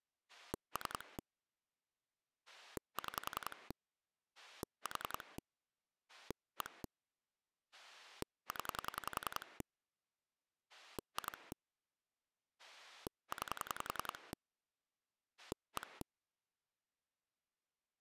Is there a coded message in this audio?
Yes: pulse dialling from 0.3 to 16.0 s, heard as a rotary dial, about 10 pulses a second. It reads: 3 6 4 1 0 2 9 1